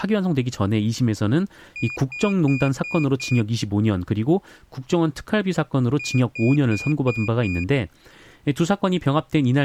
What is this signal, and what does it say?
Beep code, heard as a piezo beeper, played twice, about 2450 Hz, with speech in Korean. 5 short. In AMI BIOS tables: processor failure; in Dell tables: CMOS battery failure.